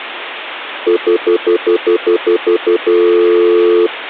Telephone call progress tone (North American plan), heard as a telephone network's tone, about 350, 440 Hz, 0.1 s on and 0.1 s off. Stutter dial tone.